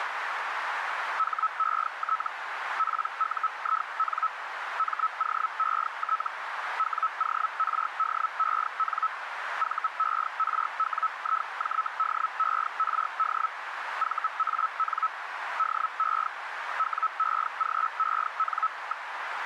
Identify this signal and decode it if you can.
Hellschreiber (Feld-Hell, 122.5 baud), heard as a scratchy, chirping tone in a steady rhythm, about 1300 Hz, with radio static and a narrow filter. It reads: HET PUIN MOET WORDEN VERWIJDERD VAN DE WEGEN.